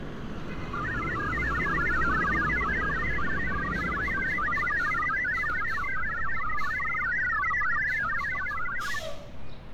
Multi-tone FSK (Olivia or MFSK type), about 1000 Hz wide, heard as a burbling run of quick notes, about 62.5 baud, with street noise.